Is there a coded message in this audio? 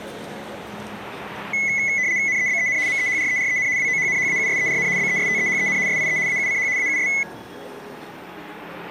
Yes: RTTY (75 baud, 170 Hz shift) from 1.5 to 7.2 s, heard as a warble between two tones, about 2100 Hz centre, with street noise. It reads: NEBEN MEHREREN WOHNHAUSERN BESTEHEN SIE AUCH AUS